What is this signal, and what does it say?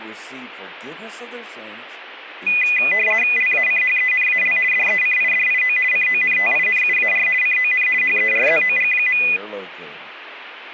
RTTY (50 baud, 450 Hz shift), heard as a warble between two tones, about 2250 Hz centre, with speech in English. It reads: LACHENAL DECIDIO CONTINUAR CON HERZOG.